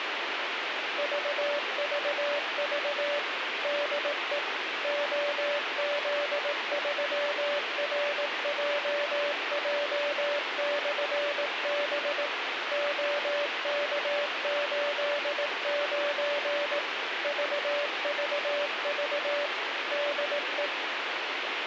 Morse code, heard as a keyed tone, machine-sent, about 18 wpm, 580 Hz, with radio hiss. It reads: VVV DE OZ3RJJ/B OK89 VVV DE